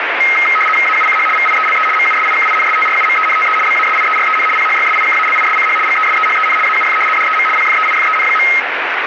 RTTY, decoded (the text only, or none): AUCH VIELE MUSIKINSTRUMENTE BASIEREN PHYSIKALISCH GESEHEN AUF DEM PFEIFEN.